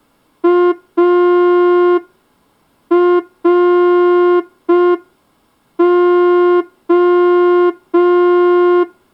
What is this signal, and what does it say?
Morse code, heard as a horn, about 5 wpm. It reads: ARO